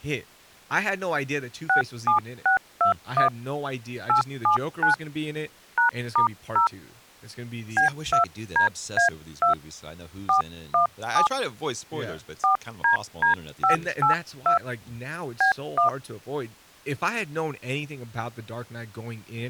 DTMF, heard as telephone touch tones, dialled by hand, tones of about 120 ms, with speech in English. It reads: 67621 879 #*0 B2DA2 417 4DD582 B1